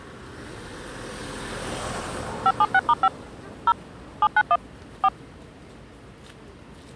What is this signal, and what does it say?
DTMF, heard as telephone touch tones, dialled by machine, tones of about 50 ms, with the noise of a residential street. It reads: 576*5 0 791 4